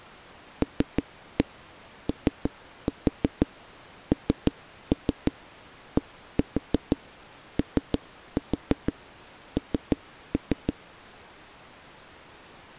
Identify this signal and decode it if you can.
Tap code, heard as knocks on a wall, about 6 knocks a second. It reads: LONDON